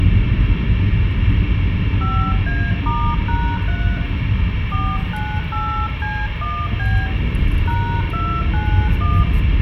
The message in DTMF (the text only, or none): 5A*#3 498C1B #291